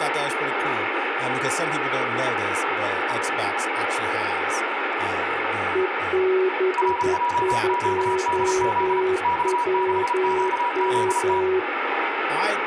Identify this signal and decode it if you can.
Morse code, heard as two keyed tones, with radio static, room echo and speech in English. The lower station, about 11 wpm, 370 Hz: EB2WM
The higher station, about 34 wpm, 970 Hz: RJQDZ X6QZT